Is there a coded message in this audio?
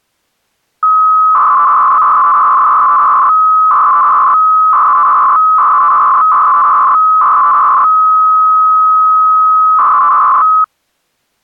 Yes: 300-baud modem data (Bell 103 tones) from 0.8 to 10.6 s, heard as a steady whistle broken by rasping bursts, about 300 baud, 200 Hz shift.